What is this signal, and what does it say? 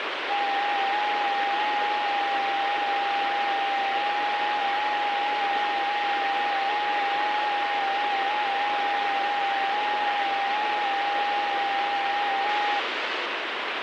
FT8 (several signals at once), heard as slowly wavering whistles, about 6.25 baud, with heavy radio static.